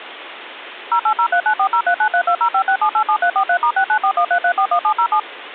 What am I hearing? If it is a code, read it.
DTMF, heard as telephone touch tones, dialled by machine, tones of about 80 ms, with phone line noise. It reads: 08039403932056787343*69413341707